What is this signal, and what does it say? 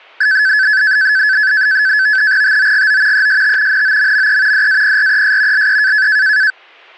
NAVTEX (SITOR-B), 100 baud, 170 Hz shift, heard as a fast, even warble, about 1600 Hz centre, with static crashes. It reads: TOGO EST NOMME DAPRES LE